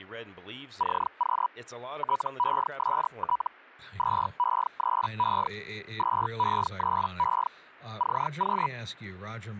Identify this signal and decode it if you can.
Hellschreiber (Feld-Hell, 122.5 baud), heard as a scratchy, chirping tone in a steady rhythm, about 980 Hz, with speech in English. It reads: CQ TEST 2E3E 2E3E CQ